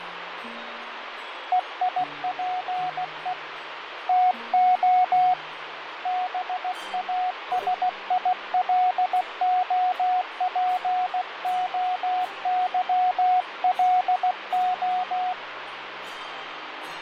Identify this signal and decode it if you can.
Morse code (Greek alphabet), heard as a keyed tone, hand-sent with a paddle, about 16 wpm, 730 Hz, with radio static and fading. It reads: ΕΙΠΕ ΤΟ ΒΑΣΙΛΟΠΟΥΛΟ